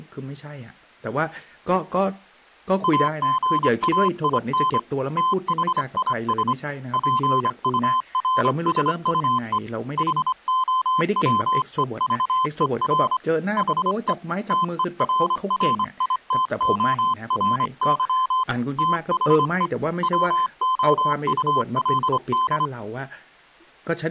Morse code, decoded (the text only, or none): AGAIN THIS PURSUE HOWEVER HE TERRITORY THE WOULD